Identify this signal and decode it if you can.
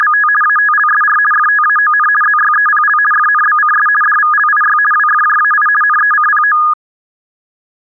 RTTY (50 baud, 450 Hz shift), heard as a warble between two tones, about 1450 Hz centre. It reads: … ATLSR FTAON ZYEPL FNBCS DVLIY WFJAI NECPO